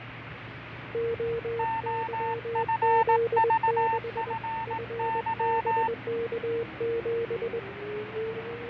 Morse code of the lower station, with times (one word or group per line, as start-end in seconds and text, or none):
0.9-4.3 OYZ6
4.7-7.6 FBK7